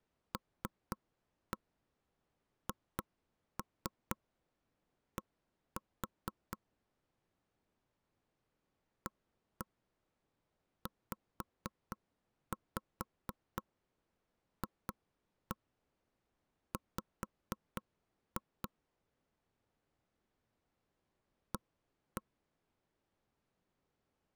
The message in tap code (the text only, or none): LHD AZFW A